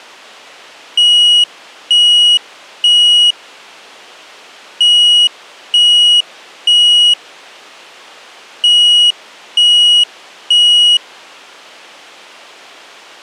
Alarm pattern, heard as an alarm's beeps, played three times, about 2900 Hz. Temporal three. Smoke or fire, evacuate.